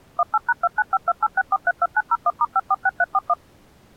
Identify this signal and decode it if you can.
DTMF, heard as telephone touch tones, dialled by machine, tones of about 40 ms. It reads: 18#295286432901*546341